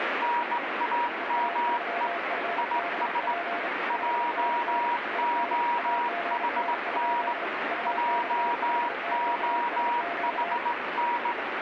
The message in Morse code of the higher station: NAME IS JOHN JOHN

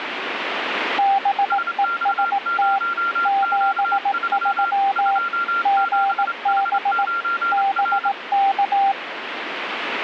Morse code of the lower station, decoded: BEST 73 GB BK

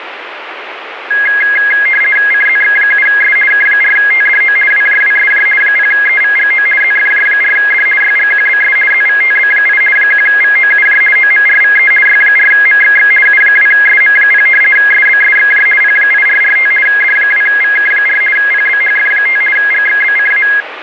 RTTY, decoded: CZX7S K4TDO WJWSJ 0EVGO ZFJ4D YGQBS ZVTB8 1VOUJ OMRVE Y4MXX U2SM0 SBSXJ P8445 D2VK4 PBHF5 GXBCA

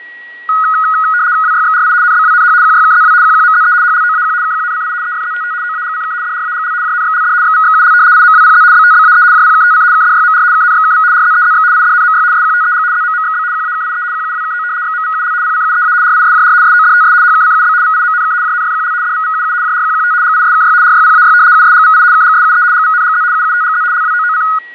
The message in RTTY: WYXRI NBWNH QYKZW QQMZE HLOAQ KQNCI EFZTT OAGCK DRAGL JNXLD XVXUL IMWPZ BTBAE JPKTC KDYMR KNXKV RZEZX IDNMY SQTEG ZMMXB QAKIE QUWKO XMVUL PCUEA RISJR SODTS HKCUB VIMNK JNFQL DVVUU JRQQT GISKY RYPAY USGVI KGSUE GVNGZ UUTGZ LWOOC

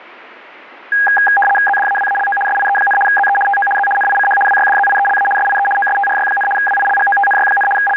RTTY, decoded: ZDAWALO SIE, ZE TO Z NICH WYDZIELA SIE OSTRY, WILGOTNY, …

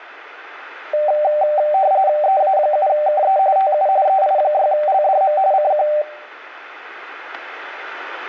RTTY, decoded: EA7KE TU EI6LDM CQ

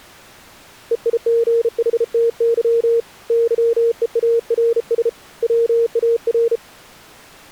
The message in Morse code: EIGHTY YEARS WAR

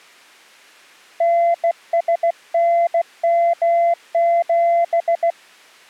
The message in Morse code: NSNM7

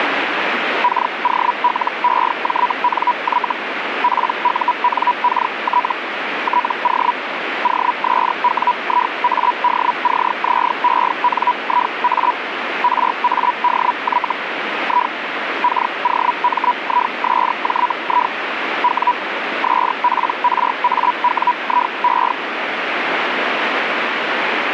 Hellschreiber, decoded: KOLEJNY PUNKT TO OSWIADCZENIA RADY I KOMISJI W SPRAWIE

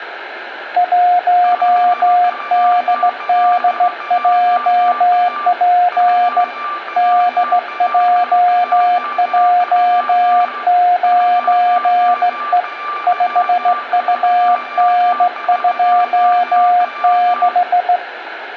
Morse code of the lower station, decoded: 1DDJP DJJ9E 5UN26

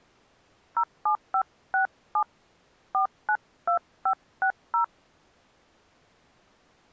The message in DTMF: 07567 492560

